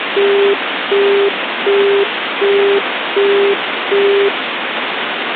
Telephone call progress tone (as in the UK, Australia and similar networks), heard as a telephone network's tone, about 400 Hz, 0.375 s on and 0.375 s off, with phone line noise. Busy tone.